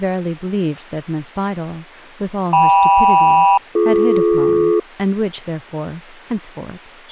Aircraft SELCAL, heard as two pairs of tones, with speech in English. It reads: KM-BD